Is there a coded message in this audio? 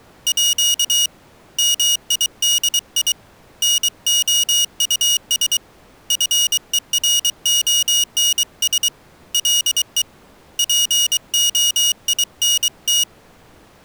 Yes: Morse code (with French letters) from 0.2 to 13.1 s, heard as a high beeper, hand-sent with a paddle, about 23 wpm, 2900 Hz. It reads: À MIDI NOUS FERONS LE POINT